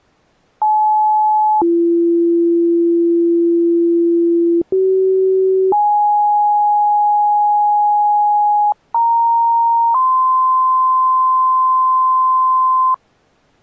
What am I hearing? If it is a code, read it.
Two-tone page, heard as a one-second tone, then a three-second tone, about 860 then 340 Hz, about 380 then 830 Hz, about 930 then 1040 Hz.